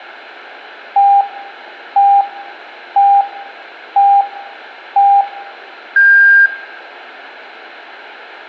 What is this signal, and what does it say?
Radio time signal (five pips and a higher one, as on Chinese radio), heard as pips, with room echo.